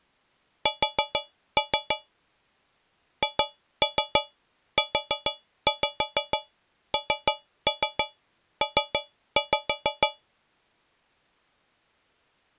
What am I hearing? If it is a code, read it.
Tap code, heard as taps on a metal pipe, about 6 knocks a second. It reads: S HUNP